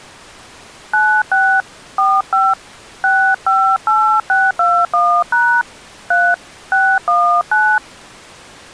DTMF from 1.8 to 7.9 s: 45 658621# 3 619

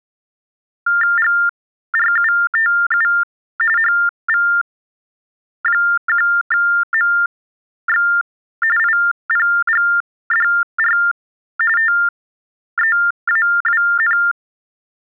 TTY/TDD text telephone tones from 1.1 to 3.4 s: GRUTU

